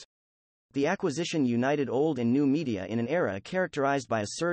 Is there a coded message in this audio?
No, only speech in English.